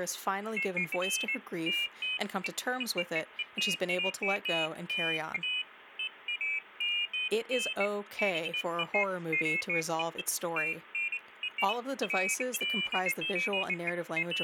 Pairs of high tones at irregular times, with speech in English. There is no code.